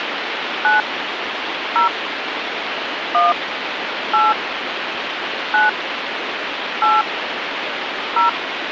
DTMF, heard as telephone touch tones, dialled by hand, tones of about 140 ms, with phone line noise. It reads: 9 0 1 8 9 8 0